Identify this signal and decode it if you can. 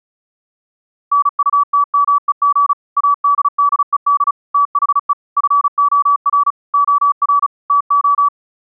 Morse code, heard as a keyed tone, machine-sent, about 35 wpm, 1150 Hz. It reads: NUTMEG ADDED THE FOR OR TO